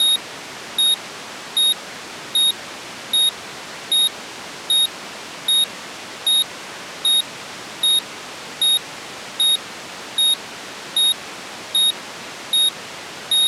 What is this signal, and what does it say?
Evenly repeated beeps. There is no code.